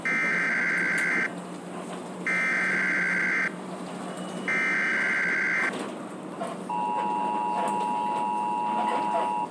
Emergency Alert System (SAME) tones (header bursts, then the 853 and 960 Hz attention tone), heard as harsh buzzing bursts, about 520.83 baud, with the noise inside a bus.